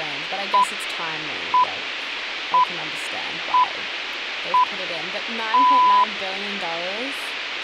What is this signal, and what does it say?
Radio time signal (six pips, as the Greenwich Time Signal), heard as pips, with speech in English.